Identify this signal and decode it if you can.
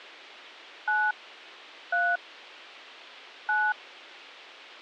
DTMF, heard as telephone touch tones, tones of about 240 ms. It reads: 9 3 9